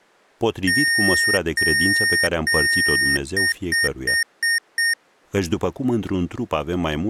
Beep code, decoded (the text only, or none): 3 long, 5 short